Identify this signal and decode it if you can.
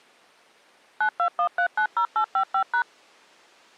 DTMF, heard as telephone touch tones, dialled by machine, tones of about 80 ms. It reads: 921390855#